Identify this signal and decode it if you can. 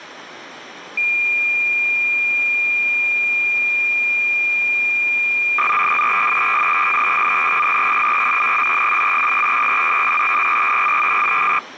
Cassette data (Kansas City type), 300 baud, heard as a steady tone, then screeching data.